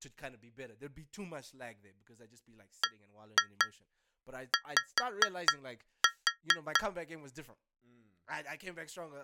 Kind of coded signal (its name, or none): tap code